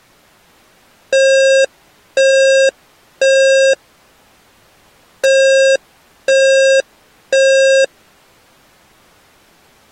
Alarm pattern, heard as an alarm's beeps, played twice, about 540 Hz. Temporal three. Smoke or fire, evacuate.